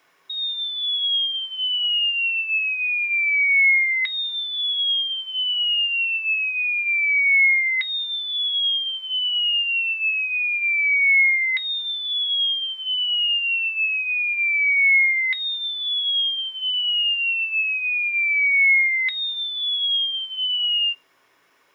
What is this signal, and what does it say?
A tone that sweeps in pitch again and again. There is no code.